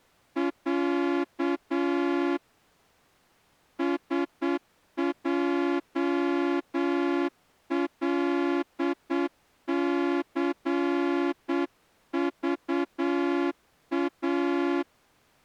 Morse code (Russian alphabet), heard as a horn, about 8 wpm. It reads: Я СЙЛЦЖА